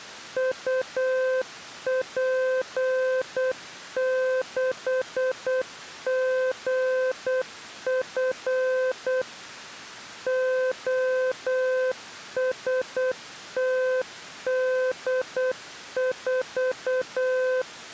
Morse code, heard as a keyed tone, machine-sent, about 8 wpm, 510 Hz. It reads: UP6GF OSTD4